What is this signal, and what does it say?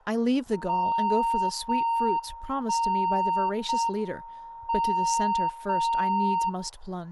Radio time signal (JJY), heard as a tone whose level steps once a second, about 920 Hz, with room echo and speech in English. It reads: 0 1 0 M 0 0